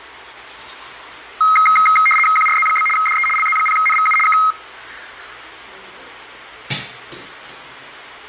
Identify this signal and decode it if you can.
RTTY (75 baud, 850 Hz shift), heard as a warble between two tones, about 1700 Hz centre, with radio static and the noise of a restroom. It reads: QRZ? DE LZ0NVU K